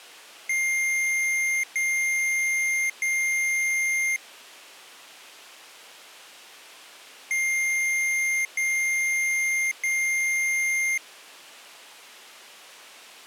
Beep code, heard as beeps from a small speaker, played twice, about 2100 Hz. 3 long. In IBM BIOS tables: keyboard card error.